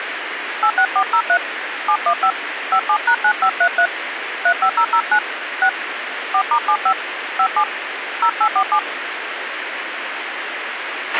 DTMF, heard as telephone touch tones, dialled by hand, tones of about 80 ms, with radio hiss and a squelch burst at the end. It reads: 86403 715 57#9533 35009 6 4*75 57 0847